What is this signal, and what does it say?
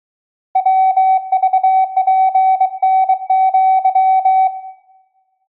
Morse code (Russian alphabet), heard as a keyed tone, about 23 wpm, 760 Hz, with room echo. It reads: ВЖПНЪ